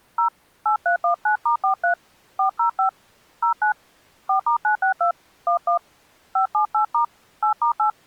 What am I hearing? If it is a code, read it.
DTMF, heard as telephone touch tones, dialled by hand, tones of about 110 ms. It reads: 0 8319*43 405 09 4*962 11 578* 8*8